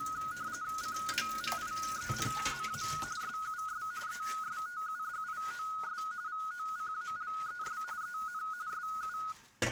RTTY (45.45 baud, 170 Hz shift), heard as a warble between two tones, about 1360 Hz centre, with kitchen noise. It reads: COMIENZA SUS ESTUDIOS VOCALES EN SU